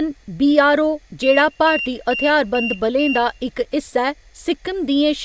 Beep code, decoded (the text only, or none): 5 short